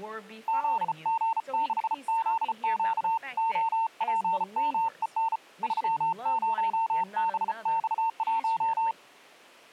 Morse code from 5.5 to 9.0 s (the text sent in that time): 30BX1